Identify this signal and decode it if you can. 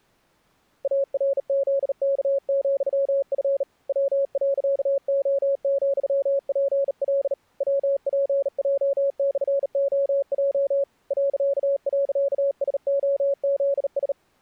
Morse code, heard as a keyed tone, hand-sent with a bug key, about 38 wpm, 560 Hz. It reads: ARZK,F W.O,PL WPJ/OJ ..SOZS